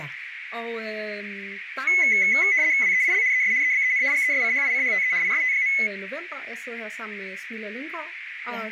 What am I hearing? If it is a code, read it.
RTTY (75 baud, 170 Hz shift), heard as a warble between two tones, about 2100 Hz centre, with radio static, a narrow filter and speech in Danish. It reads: WEIL ES EBEN GESCHICHTE IST.